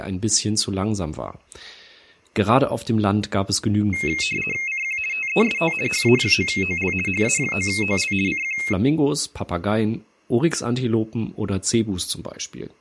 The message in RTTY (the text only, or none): CQ TEST HA9OL HA9OL CQ